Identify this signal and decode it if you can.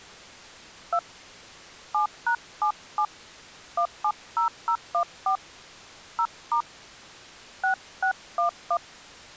DTMF, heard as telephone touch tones, dialled by hand, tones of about 90 ms. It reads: 2 7#77 170014 0* 6611